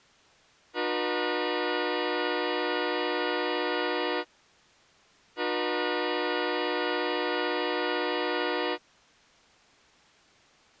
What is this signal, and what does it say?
Train horn signal, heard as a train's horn. 2 long. On North American railways: brakes released, proceed.